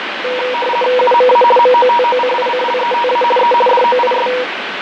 RTTY (50 baud, 450 Hz shift), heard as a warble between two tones, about 730 Hz centre, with radio static and fading. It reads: UMA MOTOCICLETA E DOIS